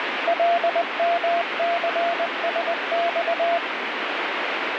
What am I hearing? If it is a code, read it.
Morse code, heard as a keyed tone, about 20 wpm, 680 Hz, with radio static. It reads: LMCSX